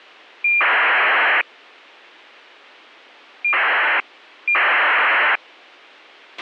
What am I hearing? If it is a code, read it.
ACARS aircraft data, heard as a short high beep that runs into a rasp, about 2400 baud, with a squelch burst at the end.